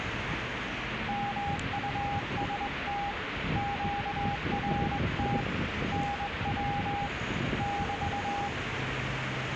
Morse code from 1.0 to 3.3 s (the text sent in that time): MUST